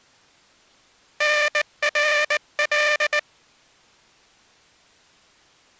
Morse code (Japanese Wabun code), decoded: タナカ

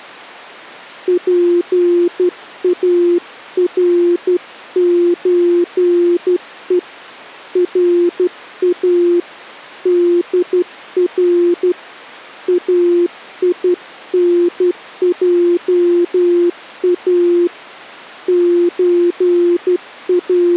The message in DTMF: none

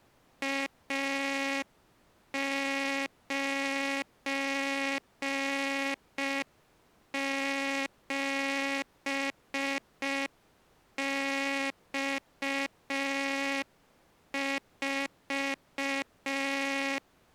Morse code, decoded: A97X4

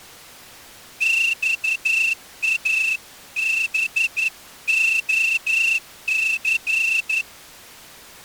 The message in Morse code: XABOC

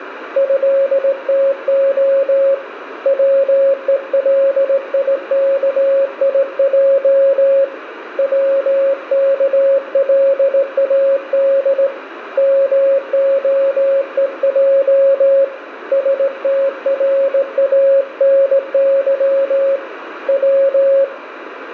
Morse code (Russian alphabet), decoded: ЭТО ВЕЛИКИЙ ВКЛАД МОЕЙ СТРАНЫ В

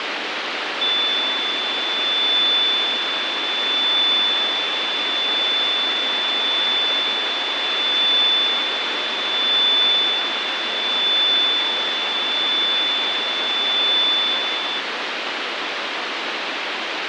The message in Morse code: none

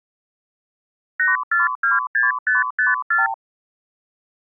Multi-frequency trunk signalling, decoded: 8426554

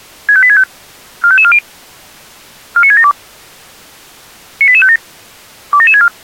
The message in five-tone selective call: 65865 45540 49672 98857 27764

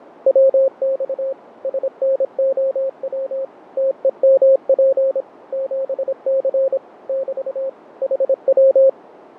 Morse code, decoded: WX SNOW TEMP 7C <BT> HW

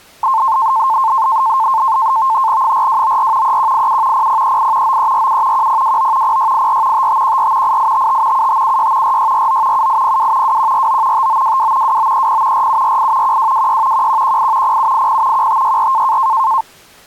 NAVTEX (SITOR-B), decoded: 4294 3187 0038 9347 1029 0684 5514 8855 7576 4649 7802 2149 5922 2930 4748 1226 1118 0780 1564

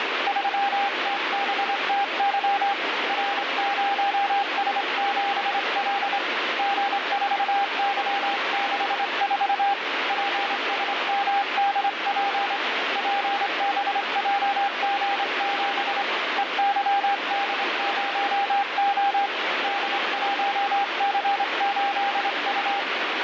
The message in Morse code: 3TBTY R0S7L G4Y64 PSMDP PBJG7 EYD0O D1C8U

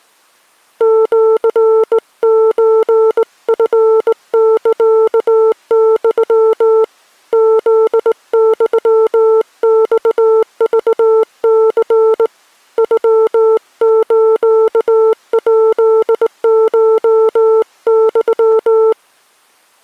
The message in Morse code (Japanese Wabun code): シソチサユ フユマクニ ノスヱコユ

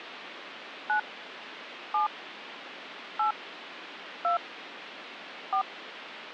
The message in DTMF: 9 7 8 2 4

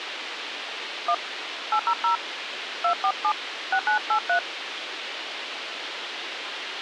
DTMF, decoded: 1 800 247 6983

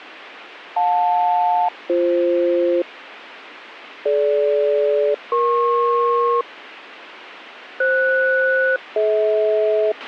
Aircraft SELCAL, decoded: JL-BF DG-EP FS-DH

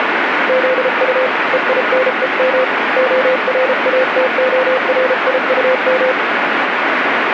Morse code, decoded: ZU EINEM ORATORIUM

